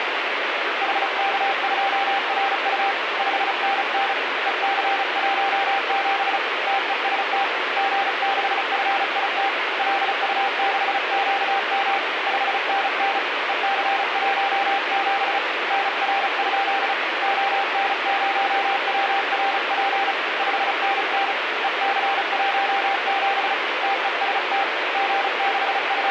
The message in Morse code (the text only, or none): HK2RU 5NN EC17 TEST G6FIT LU6QM 5NN EC17 NR? ON0WRP 5NN EC17 TEST …